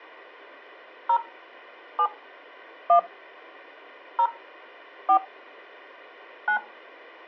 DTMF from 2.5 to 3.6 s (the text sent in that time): 1